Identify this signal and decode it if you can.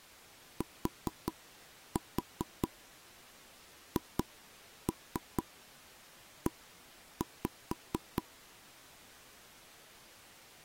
Tap code, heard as taps on a table, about 4 knocks a second. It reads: THE